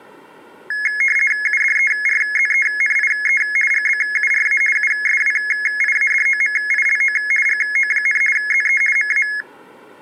RTTY (50 baud, 450 Hz shift), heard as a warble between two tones, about 1900 Hz centre. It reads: UDERZENIE GBURA USWIADOMILO GO, ZE MA